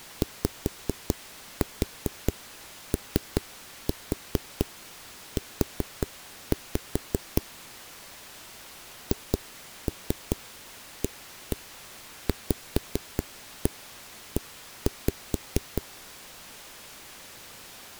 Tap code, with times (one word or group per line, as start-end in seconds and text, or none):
0.2-7.4 YOU
9.1-15.8 HAVE